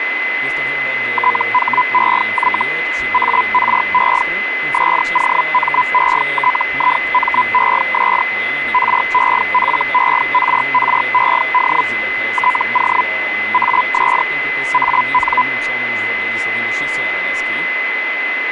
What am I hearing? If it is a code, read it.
Hellschreiber (Feld-Hell, 122.5 baud), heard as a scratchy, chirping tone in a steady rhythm, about 1000 Hz, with radio static and a steady whistle near 2030 Hz. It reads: THEY ARE SOMETIMES REFERRED TO AS AN